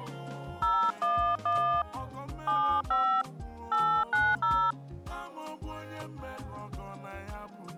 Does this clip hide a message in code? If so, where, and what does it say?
Yes: DTMF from 0.6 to 4.7 s, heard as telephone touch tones, dialled by hand, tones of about 300 ms. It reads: 011 75 890